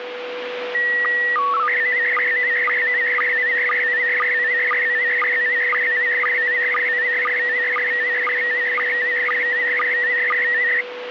SSTV (slow-scan television), PD 120, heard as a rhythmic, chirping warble, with radio static and a steady whistle near 490 Hz.